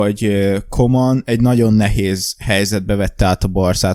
Speech in Hungarian. There is no code.